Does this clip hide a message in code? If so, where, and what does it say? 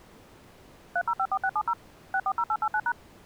Yes: DTMF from 1.0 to 2.9 s, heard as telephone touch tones, dialled by machine, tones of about 60 ms. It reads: 3054670 640889#